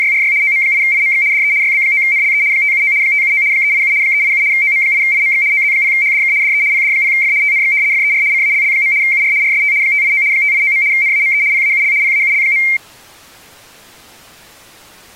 RTTY (75 baud, 170 Hz shift), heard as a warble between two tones, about 2200 Hz centre. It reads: … OM8IMX DE YB9NLE 579 579 387 387 OM8IMX OZ0HDK DE PD0F TNX FER CALL. UR RST 589 589. NAME PAUL PAUL.